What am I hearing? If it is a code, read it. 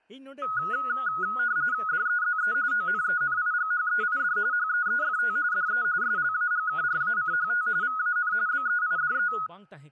RTTY (45.45 baud, 170 Hz shift), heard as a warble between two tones, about 1360 Hz centre, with speech in Santali. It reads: DEZE ONENIGHEID HEEFT DE SLAGKRACHT VAN BEIDE